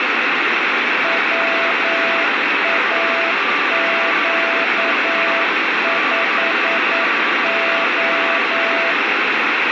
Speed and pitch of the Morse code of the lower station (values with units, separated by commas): 9 wpm, 670 Hz